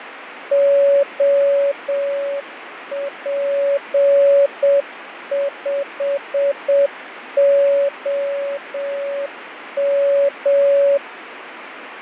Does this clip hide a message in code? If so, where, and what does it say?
Yes: Morse code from 0.5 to 11.0 s, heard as a keyed tone, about 7 wpm, 560 Hz, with radio static and fading. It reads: OP5OM